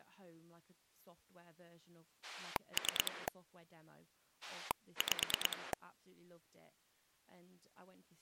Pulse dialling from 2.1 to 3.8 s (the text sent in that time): 3